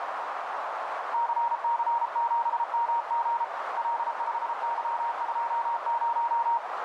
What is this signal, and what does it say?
Morse code, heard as a keyed tone, hand-sent with a paddle, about 33 wpm, 940 Hz, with heavy radio static and a narrow filter. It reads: CC7MG L5Y20